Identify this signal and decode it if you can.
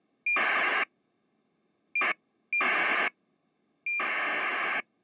ACARS aircraft data, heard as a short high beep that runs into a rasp, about 2400 baud.